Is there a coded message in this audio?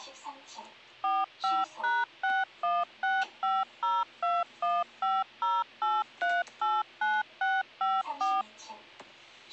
Yes: DTMF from 1.0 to 8.4 s, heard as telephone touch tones, dialled by machine, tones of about 210 ms, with the noise inside a lift. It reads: 45#6165021508389654